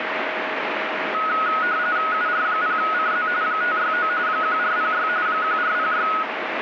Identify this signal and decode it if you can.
RTTY (45.45 baud, 170 Hz shift), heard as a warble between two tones, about 1360 Hz centre, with radio static. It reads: UR0CZ 569 1406 1406